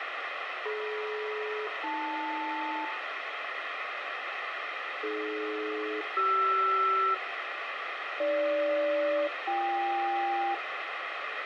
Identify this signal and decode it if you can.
Aircraft SELCAL, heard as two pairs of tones, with radio hiss and a squelch burst at the end. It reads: DM-AL AD-CR AG-BK